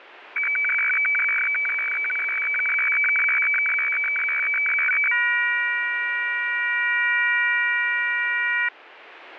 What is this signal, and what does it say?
Weather fax (radiofax), 120 lines a minute, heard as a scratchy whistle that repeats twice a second, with radio static.